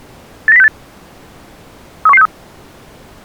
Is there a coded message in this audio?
Yes: five-tone selective call (EEA) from 0.5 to 2.3 s, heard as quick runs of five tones, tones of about 40 ms. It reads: 89068 31163